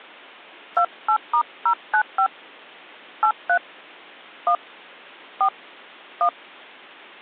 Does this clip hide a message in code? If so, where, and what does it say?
Yes: DTMF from 0.8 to 6.3 s, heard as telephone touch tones, dialled by hand, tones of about 80 ms. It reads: 28*095 83 1 4 1